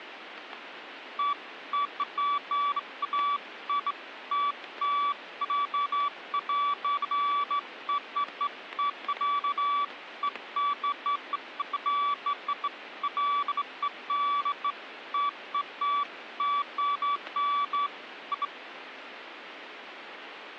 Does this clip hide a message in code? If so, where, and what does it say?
No, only beeps of irregular length.